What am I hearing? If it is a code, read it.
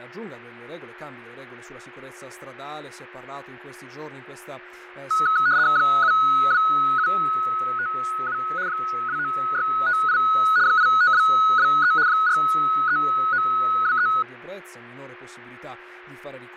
RTTY (75 baud, 170 Hz shift), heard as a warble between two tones, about 1370 Hz centre, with radio static, fading and a steady whistle near 360 Hz. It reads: 72757 29658 85223 43923